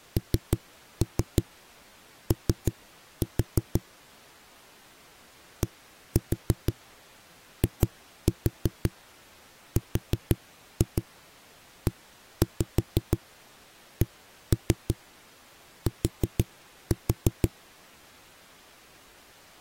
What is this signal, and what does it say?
Tap code, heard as knocks on a wall, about 6 knocks a second. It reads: NO DIRECT